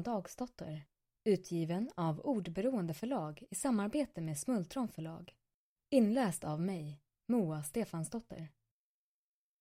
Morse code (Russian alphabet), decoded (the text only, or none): none